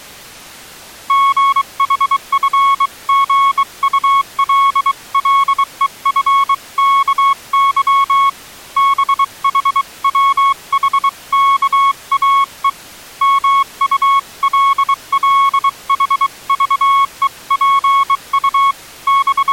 Morse code (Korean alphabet), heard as a keyed tone, hand-sent with a bug key, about 23 wpm, 1100 Hz. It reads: 순식간에 두부와 미꾸라지 …